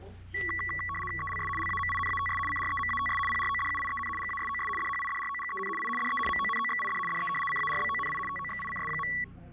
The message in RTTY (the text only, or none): ELS LAMINATS CREMATS PRODUIEN GASOS DHIDROGEN I DE MONOXID DE CARBONI TOXICS.